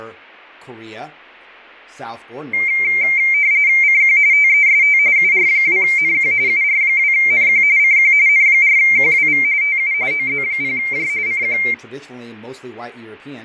RTTY (45.45 baud, 170 Hz shift), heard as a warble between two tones, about 2200 Hz centre, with fading and speech in English. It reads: CQ TEST UR2NQ UR2NQ CQ N4QWV TU OZ0J CQ